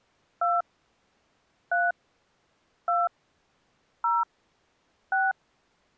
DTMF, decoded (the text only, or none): 2 3 2 0 6